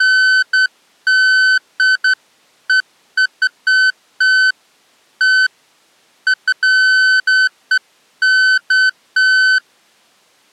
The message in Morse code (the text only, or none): none